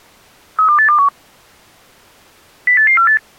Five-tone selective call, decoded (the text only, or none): 32821 08848